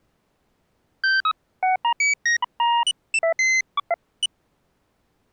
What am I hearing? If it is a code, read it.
Electronic bleeps of random pitch and length. There is no code.